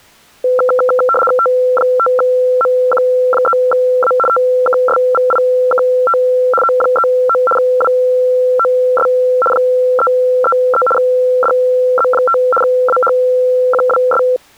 RTTY (75 baud, 850 Hz shift), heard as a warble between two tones, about 930 Hz centre. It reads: T5MQ3A TKSVIKT O39 WOS 333 DZ5 AHQWS